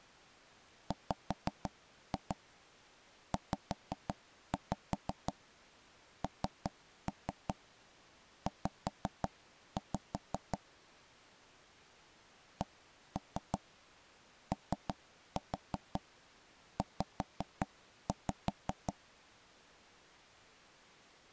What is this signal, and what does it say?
Tap code, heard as knocks on wood, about 5 knocks a second. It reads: WZNZ COZ